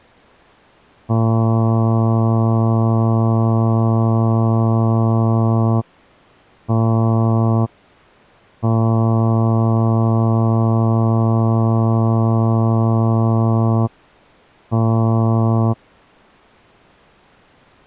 Ship horn signal, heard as a ship's horn, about 110 Hz. 1 long, 1 short, 1 long, 1 short. At sea: I agree to be overtaken.